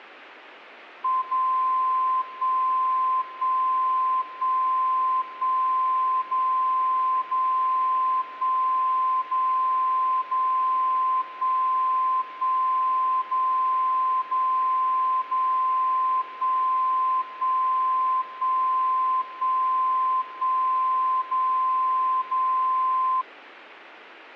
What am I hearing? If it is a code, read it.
Radio time signal (DCF77), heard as a tone whose level steps once a second, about 1040 Hz. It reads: 0 1 1 1 1 0 0 1 0 0 1 1 0 0 0 1 1 1 1 1 0 0